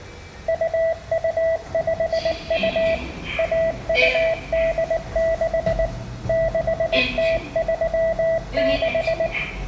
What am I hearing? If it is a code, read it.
Morse code (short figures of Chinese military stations), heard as a keyed tone, machine-sent, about 19 wpm, 660 Hz, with room echo and the noise inside a lift. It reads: 2252 1286 6036